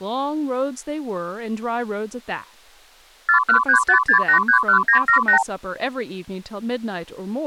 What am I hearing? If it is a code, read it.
Multi-frequency trunk signalling (R2, with the far end's replies), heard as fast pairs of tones, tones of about 100 ms, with speech in English. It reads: 41356831978